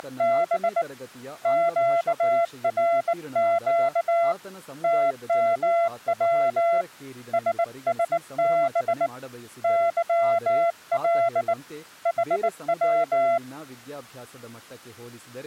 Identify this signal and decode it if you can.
Morse code, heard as a keyed tone, hand-sent with a bug key, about 19 wpm, 680 Hz, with speech in Kannada. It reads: … QRQ TMW SSB YL HW